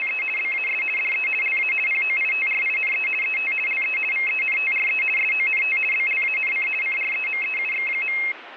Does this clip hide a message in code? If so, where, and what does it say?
Yes: RTTY (50 baud, 450 Hz shift) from 0.0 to 8.3 s, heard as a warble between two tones, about 2350 Hz centre, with radio static. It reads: … BAS DE LA POITRINE ET LE VENTRE SONT BLANC CREMEUX.